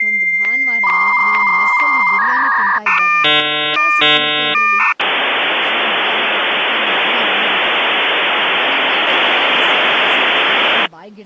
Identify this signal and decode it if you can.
Dial-up modem handshake (V.34 or later), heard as a whistle, warbles, then hiss, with speech in Kannada.